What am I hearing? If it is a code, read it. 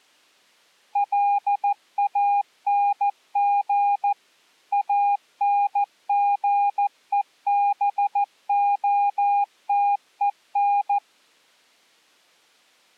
Morse code, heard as a keyed tone, machine-sent, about 14 wpm, 810 Hz. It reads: LANG ANGEBOTEN